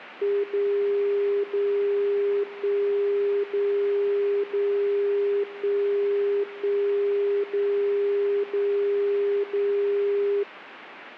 Radio time signal (DCF77), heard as a tone whose level steps once a second, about 400 Hz. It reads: 0 0 1 0 0 1 1 0 0 0